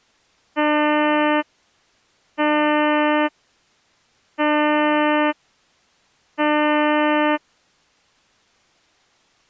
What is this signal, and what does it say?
Ship horn signal, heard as a ship's horn, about 300 Hz. 4 short. At sea: a pilot vessel's identity signal in fog.